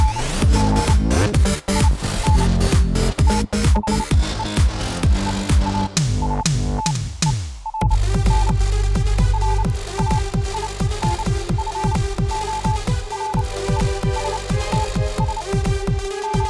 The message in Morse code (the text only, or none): … IN THE EASTERN RAINFORESTS …